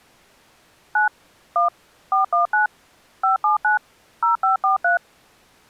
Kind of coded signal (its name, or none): DTMF